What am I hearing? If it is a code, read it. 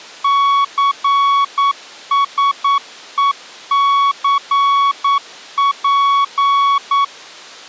Morse code (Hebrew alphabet), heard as a keyed tone, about 9 wpm, 1120 Hz. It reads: סשוסף